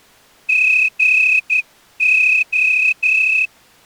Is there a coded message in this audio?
Yes: Morse code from 0.4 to 3.5 s, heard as a whistle, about 11 wpm. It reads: GO